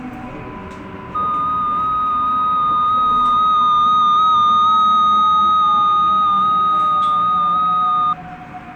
FT8 (one signal), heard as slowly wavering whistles, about 6.25 baud, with radio static and the noise inside a subway train.